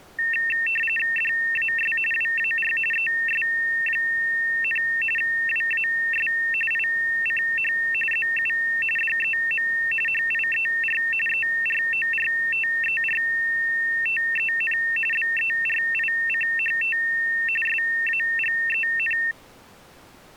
RTTY (45.45 baud, 850 Hz shift), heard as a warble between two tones, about 2250 Hz centre. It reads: DAS WAR ES, WAS ICH ZU DEM HIER ERORTERTEN BERICHT SAGEN